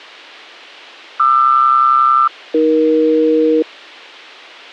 Aircraft SELCAL, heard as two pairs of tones. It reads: QR-AE